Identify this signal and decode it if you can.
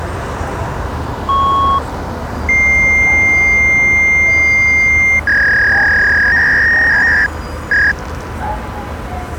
Fax machine handshake, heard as a beep, a long tone and a warble, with street noise.